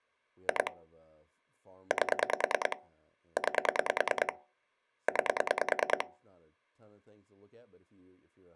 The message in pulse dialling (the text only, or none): 2 8 9 9